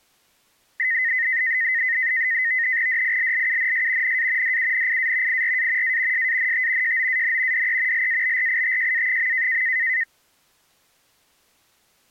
NAVTEX (SITOR-B), 100 baud, 170 Hz shift, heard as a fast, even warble, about 1950 Hz centre. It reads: DILLUNS NA DUNIA IRA A SANT JOAN DE LABRITJA.